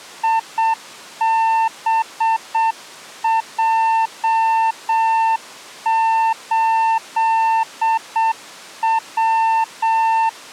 Morse code, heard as a keyed tone, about 7 wpm, 900 Hz. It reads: IBJ8W